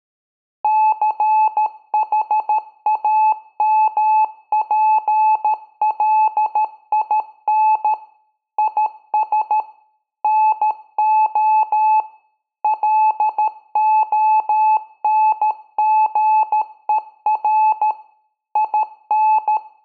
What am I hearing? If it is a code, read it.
Morse code, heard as a keyed tone, machine-sent, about 13 wpm, 860 Hz, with room echo. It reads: CHAMPLIN IS NO LONGER IN